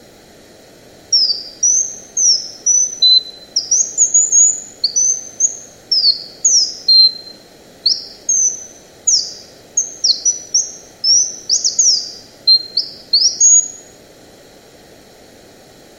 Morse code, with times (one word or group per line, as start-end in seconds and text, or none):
none